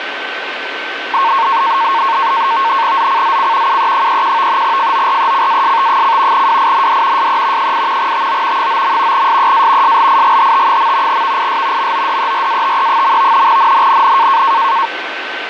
NAVTEX (SITOR-B), 100 baud, 170 Hz shift, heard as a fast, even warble, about 1000 Hz centre, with radio static and a steady whistle near 1540 Hz. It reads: ZCZC UE31 FORECAST: WIND SE 8 TO 9. SEA SLIGHT. VIS MODERATE. NNNN